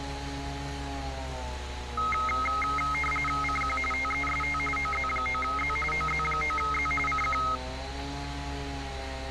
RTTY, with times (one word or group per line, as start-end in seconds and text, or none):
3.4-3.8 CQ
3.9-4.6 TEST
4.8-5.8 OZ9Z
5.9-6.9 OZ9Z
7.1-7.4 CQ